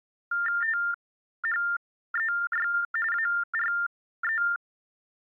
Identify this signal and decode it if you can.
TTY/TDD text telephone tones (45.45 baud Baudot), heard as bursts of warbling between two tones, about 400 Hz shift, 1600 Hz centre. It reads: THEY ARE